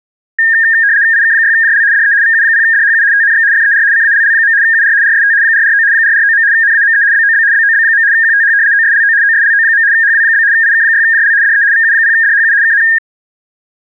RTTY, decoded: IK6JL DE VU0DHU TNX FER CALL. UR RST 449 449. NAME BOB BOB. QTH OSLO OSLO. HW? IK6JL DE VU0DHU KN

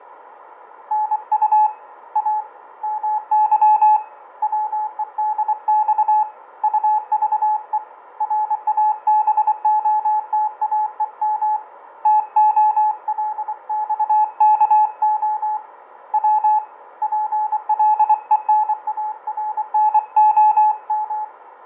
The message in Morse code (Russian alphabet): НУ А МЫ ВЕДЬ УЖЕ РАБОТАЕМ ТОЛЬКО В ПЛЕНАРНОМ

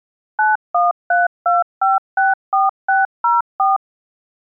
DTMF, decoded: 9132564604

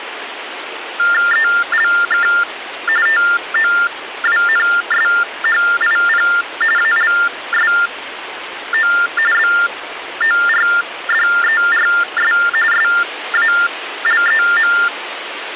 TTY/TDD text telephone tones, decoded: ELK TOWNSHIP ALSO BORDERS SALEM

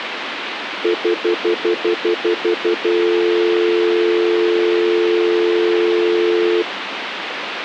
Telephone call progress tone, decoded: stutter dial tone

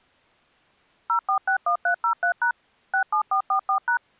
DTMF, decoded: 0461303# 67444#

